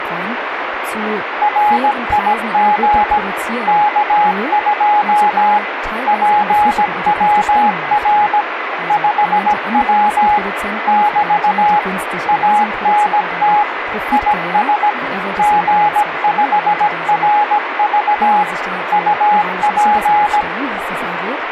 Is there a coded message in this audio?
Yes: Morse code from 1.4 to 20.5 s, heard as a keyed tone, machine-sent, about 17 wpm, 840 Hz, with radio static, a weaker station near 2020 Hz and speech in German. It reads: RIG K2 PWR 5W <BT> ANT IS G5RV UP